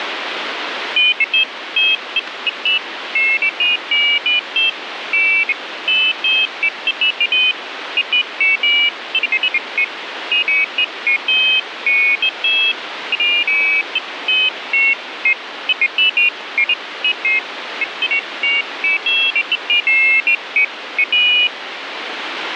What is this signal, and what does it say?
Pairs of high tones at irregular times, with radio static. There is no code.